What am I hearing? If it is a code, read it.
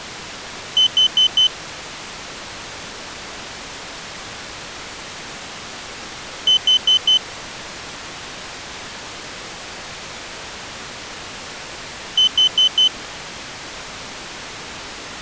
Alarm pattern, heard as an alarm's beeps, played three times, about 3050 Hz. Temporal four. Carbon monoxide.